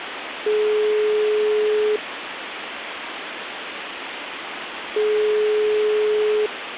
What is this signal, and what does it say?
Telephone call progress tone (single-tone plan, as in most of Europe), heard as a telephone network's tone, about 420 Hz, 1.5 s on and 3 s off, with phone line noise. Ringback tone.